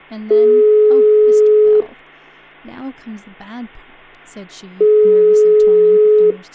Telephone call progress tone (single-tone plan, as in most of Europe), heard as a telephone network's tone, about 420 Hz, 1.5 s on and 3 s off, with hum and speech in English. Ringback tone.